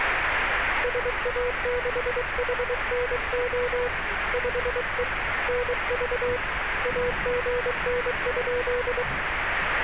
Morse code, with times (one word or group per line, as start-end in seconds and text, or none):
0.8-3.9 SA6HNO
4.3-5.0 5E
5.5-6.4 NV
6.9-9.0 AGN?